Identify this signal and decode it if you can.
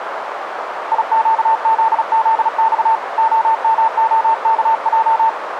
Morse code, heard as a keyed tone, hand-sent with a paddle, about 36 wpm, 900 Hz, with radio static and a narrow filter. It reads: IQZZX OMOKJ